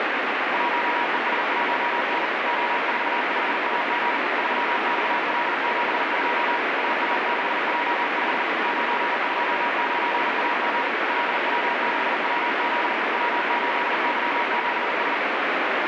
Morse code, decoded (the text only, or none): 1ES1N O45AG 3XL72 AA6J5 929AG LW6WZ W8Y7S